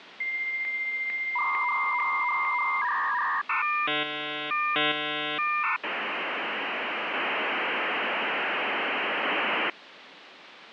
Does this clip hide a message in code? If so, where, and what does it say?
Yes: dial-up modem handshake (V.34 or later) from 0.2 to 9.7 s, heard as a whistle, warbles, then hiss, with phone line noise.